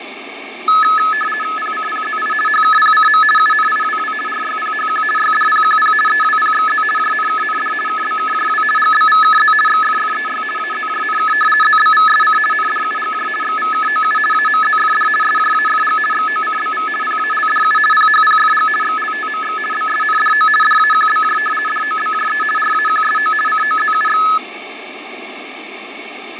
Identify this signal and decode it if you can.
RTTY (50 baud, 450 Hz shift), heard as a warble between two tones, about 1500 Hz centre, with radio static and fading. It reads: PCPZI HKPCM UNIWW RYPHQ YDPQP EWPXZ JNKND KBKJW GBVKZ XFFEY AZJNK ZBVSC NDUGJ XVKOU AMZFD SJAFG XOCBV PALDU PHPFG XLTMX BSNDO DAQBJ DOBJE RAQSO COZUX